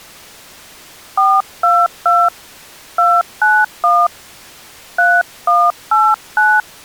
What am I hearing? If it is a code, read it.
DTMF, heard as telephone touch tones, dialled by hand, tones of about 230 ms. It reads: 422 291 3189